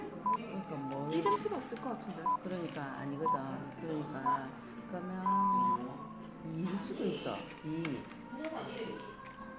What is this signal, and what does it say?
Radio time signal (six pips, as the Greenwich Time Signal), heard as pips, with the noise of a crowd indoors.